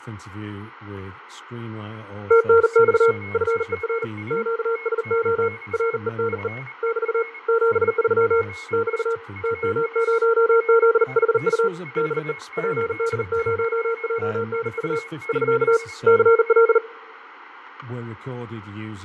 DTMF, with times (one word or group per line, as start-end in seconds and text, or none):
none